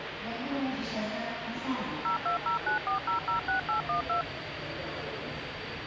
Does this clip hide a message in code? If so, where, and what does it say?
Yes: DTMF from 2.1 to 4.2 s, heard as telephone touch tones, dialled by machine, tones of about 120 ms, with phone line noise and the noise of a subway station. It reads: 02094006812